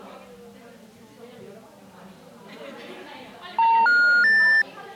Telephone call progress tone (North American plan), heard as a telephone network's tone, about 910, 1430, 1800 Hz, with the noise of a crowd indoors. Special information tone.